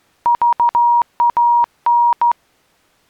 Morse code, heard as a keyed tone, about 14 wpm, 950 Hz. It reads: VAN